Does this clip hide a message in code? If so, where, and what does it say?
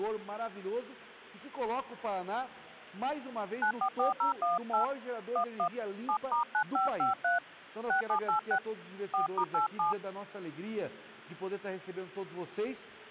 Yes: DTMF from 3.6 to 9.9 s, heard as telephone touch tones, dialled by hand, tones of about 120 ms. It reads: 944018 11 7*9553 6786 4*87